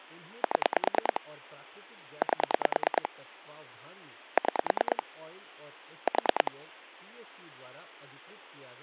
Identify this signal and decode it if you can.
Pulse dialling, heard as clicks on a phone line, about 9 pulses a second, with speech in Hindi. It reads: 7 8 6 4